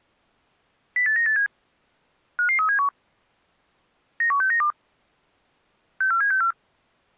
Five-tone selective call (CCIR), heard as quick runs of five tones, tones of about 100 ms. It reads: 08987 55371 91692 64764